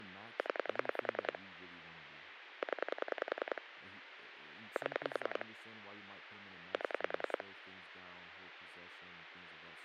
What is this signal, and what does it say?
Pulse dialling, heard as clicks on a phone line, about 10 pulses a second, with phone line noise and speech in English. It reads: 0 0 7 7